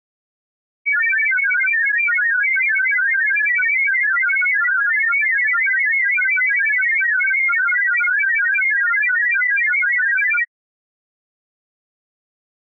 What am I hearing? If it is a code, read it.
Multi-tone FSK (Olivia or MFSK type), about 1000 Hz wide, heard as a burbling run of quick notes, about 31.25 baud.